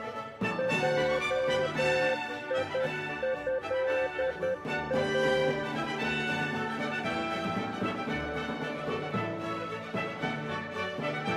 Morse code (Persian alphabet), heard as a keyed tone, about 10 wpm, 520 Hz. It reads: جیضا